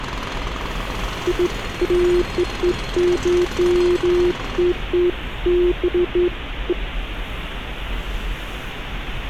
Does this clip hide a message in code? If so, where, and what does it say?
No, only beeps of irregular length, with street noise.